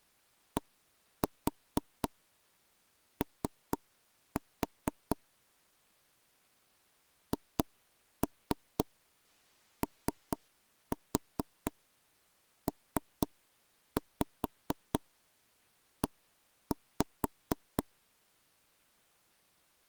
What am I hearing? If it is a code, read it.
Tap code, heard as taps on a table, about 4 knocks a second. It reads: DO HOPE